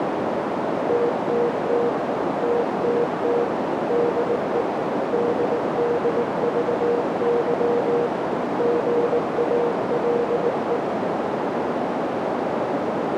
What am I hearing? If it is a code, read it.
Morse code, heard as a keyed tone, hand-sent with a paddle, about 19 wpm, 480 Hz, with heavy radio static and a narrow filter. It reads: TTT TTT DE DDVY GALE